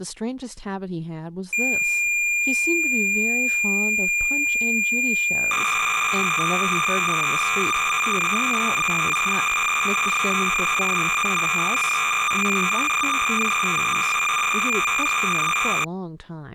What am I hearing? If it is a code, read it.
Cassette data (Kansas City type), 300 baud, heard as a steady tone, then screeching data, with speech in English.